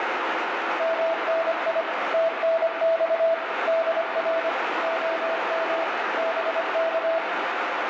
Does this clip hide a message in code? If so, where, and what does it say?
Yes: Morse code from 0.7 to 7.2 s, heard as a keyed tone, machine-sent, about 25 wpm, 660 Hz, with heavy radio static. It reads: MNI TNX DR OM BK